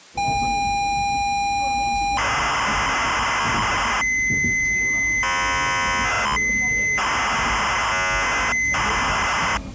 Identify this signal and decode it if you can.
ZX Spectrum tape loading, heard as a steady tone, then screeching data, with the noise inside a subway train.